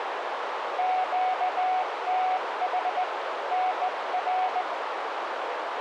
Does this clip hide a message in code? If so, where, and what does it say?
Yes: Morse code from 0.7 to 4.7 s, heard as a keyed tone, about 17 wpm, 740 Hz, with radio static and a narrow filter. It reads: QTH NR